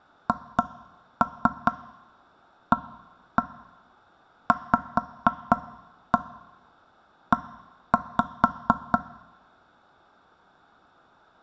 Tap code, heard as knocks on wood, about 4 knocks a second. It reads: HAVE